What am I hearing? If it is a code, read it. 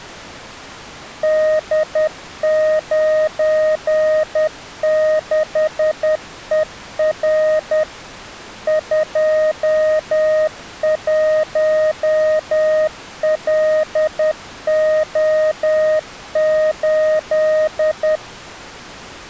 Morse code, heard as a keyed tone, machine-sent, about 10 wpm, 620 Hz. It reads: D96ER 21LO8